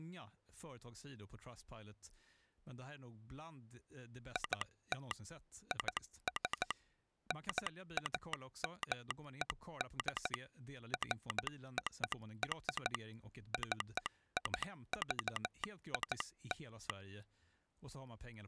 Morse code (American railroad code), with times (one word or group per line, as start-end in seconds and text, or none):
4.4-5.1 IT
5.7-6.7 IS
7.3-10.3 NAMED
10.9-12.9 FOR
13.5-16.9 CIVIL